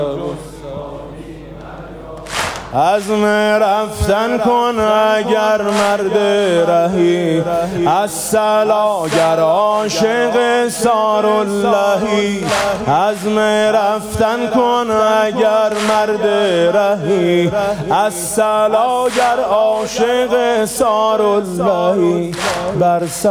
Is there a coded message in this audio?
No.